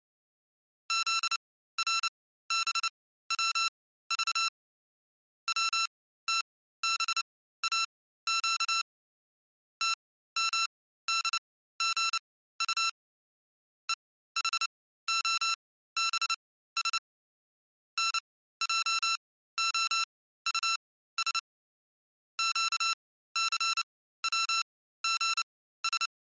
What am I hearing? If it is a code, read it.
Morse code, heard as electronic beeps, machine-sent, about 29 wpm, spaced as for 15 wpm, 1340 Hz. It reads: ZRBWV WTBAQ TMDGU EHOBS NJOUS QCWGS